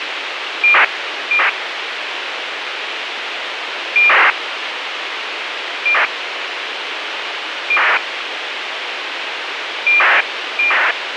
ACARS aircraft data, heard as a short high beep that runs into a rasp, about 2400 baud, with radio hiss.